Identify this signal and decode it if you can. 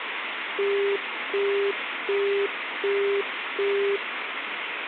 Telephone call progress tone (as in the UK, Australia and similar networks), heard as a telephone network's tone, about 400 Hz, 0.375 s on and 0.375 s off, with phone line noise. Busy tone.